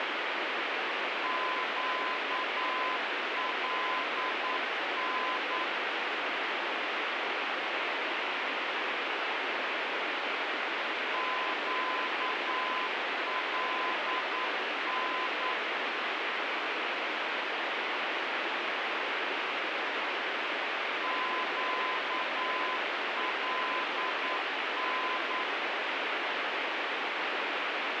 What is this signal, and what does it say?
Morse code, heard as a keyed tone, machine-sent, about 9 wpm, 1020 Hz, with heavy radio static. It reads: QLN QLN QLN